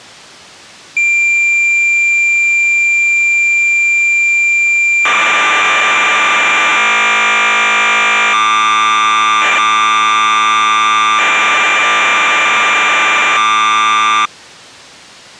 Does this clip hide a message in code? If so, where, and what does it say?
Yes: cassette data (Kansas City type), 1200 baud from 1.0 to 14.3 s, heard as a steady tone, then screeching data.